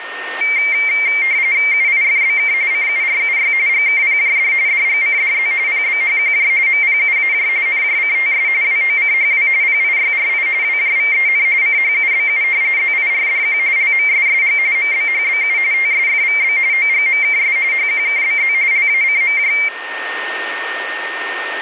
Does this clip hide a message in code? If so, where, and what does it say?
Yes: RTTY (45.45 baud, 170 Hz shift) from 0.4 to 19.7 s, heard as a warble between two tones, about 2200 Hz centre, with radio static and a steady whistle near 1830 Hz. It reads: UIFBK CURUY GKPJD DGCDZ PBHQJ MPUAJ NJCTS WOCHW PIYRI WJVEN CHUBU ZIRDQ LMSSG MBHBU TSFVB OGMKS HQKBZ LACMJ